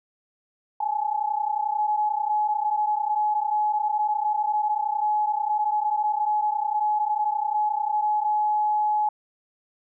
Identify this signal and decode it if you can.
PSK31 (31.25 baud), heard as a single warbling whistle, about 850 Hz.